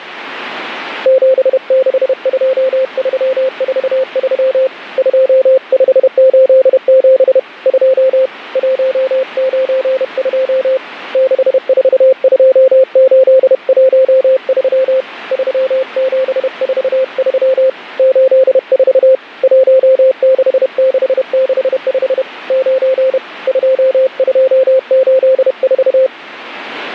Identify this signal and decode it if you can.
Morse code, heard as a keyed tone, hand-sent with a paddle, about 31 wpm, 520 Hz. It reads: 762343 2587 2 192 642813 3743 84 16665 9 2284